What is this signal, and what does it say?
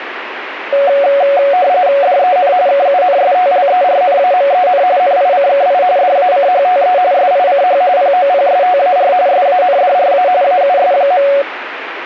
RTTY (45.45 baud, 170 Hz shift), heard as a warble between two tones, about 640 Hz centre, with radio static. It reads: DEN KUNSTLERNAMEN NICKI DACHTE SICH POPSTAR SANDRA AUS.